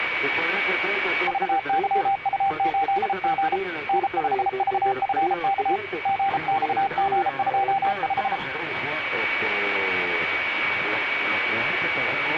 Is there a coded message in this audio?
Yes: Morse code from 1.2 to 8.4 s, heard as a keyed tone, hand-sent with a paddle, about 33 wpm, 790 Hz, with radio static and a steady whistle near 2270 Hz. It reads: VYU8G N5VFK GXG25